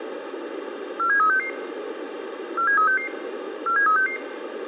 Five-tone selective call (CCIR), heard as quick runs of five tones, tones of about 100 ms, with radio hiss and a squelch burst at the end. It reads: 47366 47366 47366